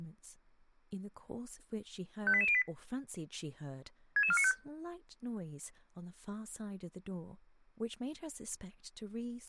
Five-tone selective call (ZVEI), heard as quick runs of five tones, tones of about 70 ms, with speech in English. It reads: 58808 66495